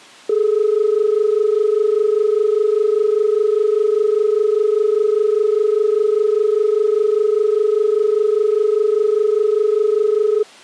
Telephone call progress tone (as in Australia), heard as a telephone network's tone, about 430 Hz. Dial tone.